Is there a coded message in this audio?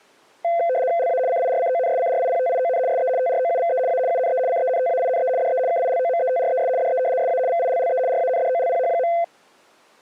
Yes: RTTY (75 baud, 170 Hz shift) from 0.4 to 9.2 s, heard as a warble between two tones, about 600 Hz centre. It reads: LA CIRCONSCRIPTION SE TROUVE A UNE CENTAINE DE KILOMETRES DE SA VILLE RANDOLPH.